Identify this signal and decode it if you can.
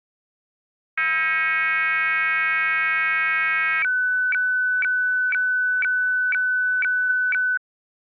Weather fax (radiofax), 120 lines a minute, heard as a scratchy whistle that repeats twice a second.